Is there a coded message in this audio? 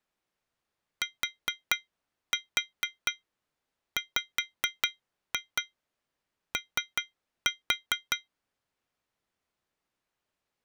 Yes: tap code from 1.0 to 8.3 s, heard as taps on glass, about 4 knocks a second. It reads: TWO